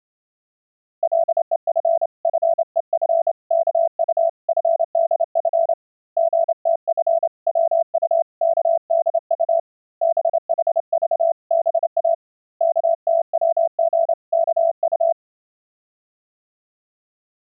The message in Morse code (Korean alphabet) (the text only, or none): 간난이는 선비의 둘도 없이